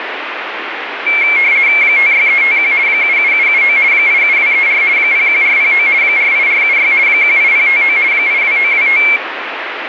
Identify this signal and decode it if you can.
RTTY (50 baud, 170 Hz shift), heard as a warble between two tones, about 2250 Hz centre, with radio static. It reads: 56351 77779 87234 01409 48476 18059 82925